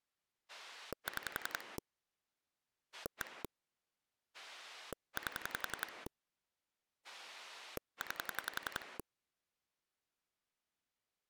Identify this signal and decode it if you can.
Pulse dialling, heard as a rotary dial, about 11 pulses a second. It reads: 6 1 8 9